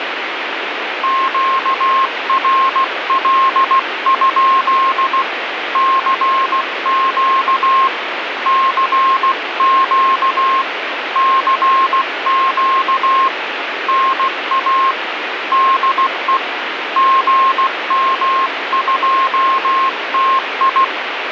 Morse code, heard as a keyed tone, hand-sent with a paddle, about 16 wpm, 1070 Hz, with radio static. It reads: QRL? CQ CQ CQ NA DE GM2TI